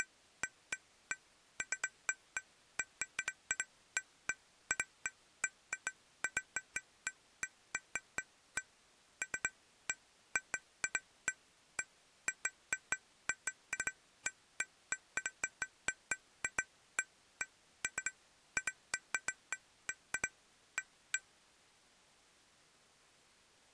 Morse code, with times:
none

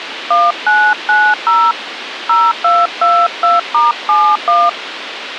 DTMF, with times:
0.3-1.7 1990
2.3-4.7 0222*71

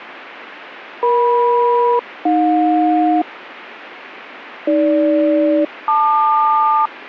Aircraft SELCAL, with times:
1.0-3.2 EM-AJ
4.7-6.9 AG-LQ

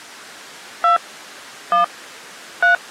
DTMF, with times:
0.8-1.0 2
1.7-1.8 1
2.6-2.7 3

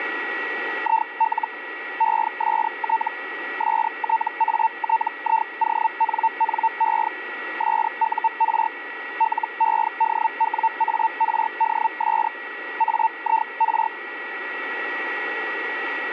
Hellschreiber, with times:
0.8-1.5 IL
2.0-3.1 EST
3.6-7.1 STATIONNE
7.6-8.7 SUR
9.2-12.3 LEDWARDS
12.8-13.9 AIR

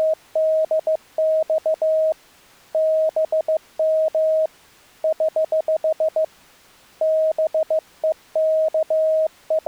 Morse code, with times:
0.0-2.1 …
2.7-4.5 BM
5.0-6.2 <HH>
7.0-9.7 …

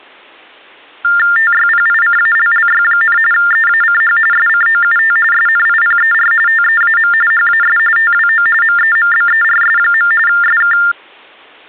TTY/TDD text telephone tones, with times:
1.4-3.2 TYPICALLY,
3.3-4.2 EACH
4.3-5.2 SCOUT
5.3-6.3 SNIPER
6.5-7.1 TEAM
7.3-7.8 HAS
8.0-8.5 TWO
8.6-10.1 MEMBERS.
10.3-10.8 SK

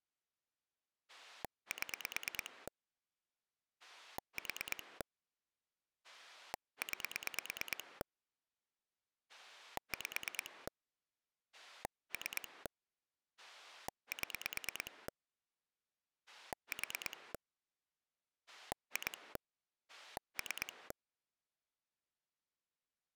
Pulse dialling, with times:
1.1-2.7 7
3.8-5.0 4
6.0-8.0 9
9.3-10.7 5
11.5-12.7 3
13.4-15.1 7
16.3-17.3 4
18.5-19.4 2
19.9-20.9 3

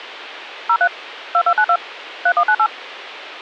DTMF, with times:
0.7-0.9 03
1.3-1.8 2292
2.3-2.7 3198

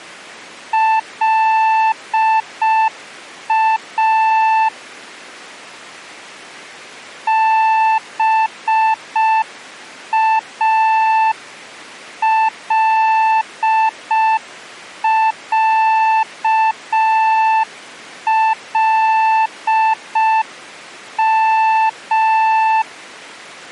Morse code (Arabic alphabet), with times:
0.7-4.7 لا
7.3-22.8 بالعلم

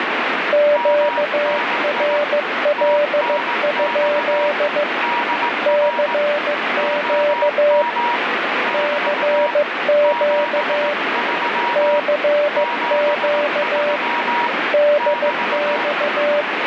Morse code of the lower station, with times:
0.5-4.8 QRL?
5.7-7.8 CQ
8.7-10.9 CQ
11.8-14.0 CQ
14.7-16.4 DX

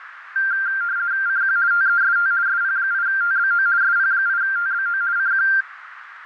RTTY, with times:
1.3-1.6 CQ
1.7-2.3 TEST
2.5-3.7 SP8TBO
3.8-5.0 SP8TBO
5.2-5.5 CQ

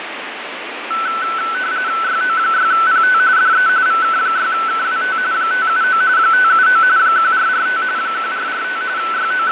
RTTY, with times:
2.0-3.2 YO6PT
3.4-3.7 DE
3.9-5.2 VK6KWT
5.3-6.0 579
6.2-6.8 579
7.0-7.8 1445
8.0-8.8 1445
9.0-9.5 …

